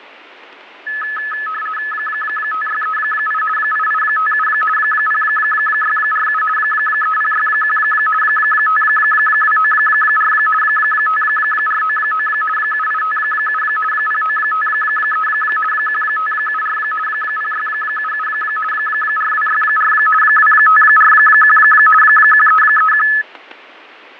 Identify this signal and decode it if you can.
RTTY (50 baud, 450 Hz shift), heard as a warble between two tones, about 1500 Hz centre, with radio static, fading and static crashes. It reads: 5638 8857 0647 3061 5294 5499 7857 0953 1574 0677 4264 2541 1331